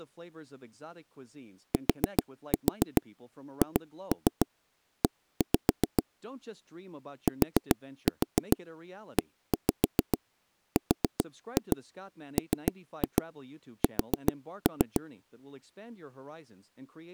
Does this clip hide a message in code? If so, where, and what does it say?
Yes: tap code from 1.7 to 15.0 s, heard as taps on a table, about 7 knocks a second, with speech in English. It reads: THE TERMS